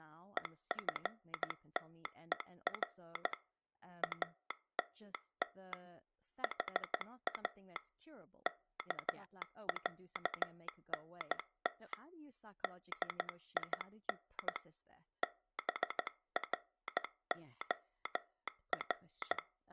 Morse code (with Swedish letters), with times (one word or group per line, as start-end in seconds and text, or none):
0.4-3.3 EFTER
4.0-5.7 ATT
6.4-7.8 HA
8.5-11.9 KÄNT
12.6-14.6 DIN
15.2-19.4 BROR